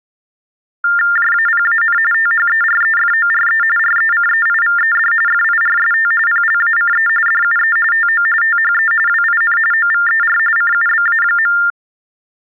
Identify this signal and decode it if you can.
TTY/TDD text telephone tones (45.45 baud Baudot), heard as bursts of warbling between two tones, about 400 Hz shift, 1600 Hz centre. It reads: JAPAN THEREFORE RECEIVED FIRST PLACE DUE TO THE WIN OVER CUBA.